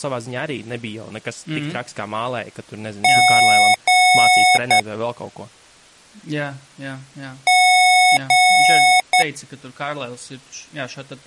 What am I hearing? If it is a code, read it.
Beep code, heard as beeps from a small speaker, played twice, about 730 Hz, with speech in Latvian. 2 long, 1 short.